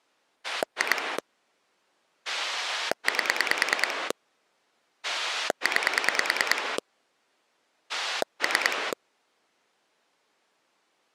Pulse dialling, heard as a rotary dial, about 9 pulses a second. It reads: 2 8 9 3